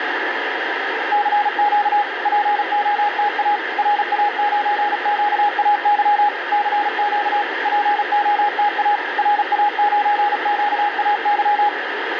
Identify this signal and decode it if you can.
Morse code, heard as a keyed tone, machine-sent, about 36 wpm, 830 Hz, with radio static. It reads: CQ POTA RA9QAY CQ POTA RA9QAY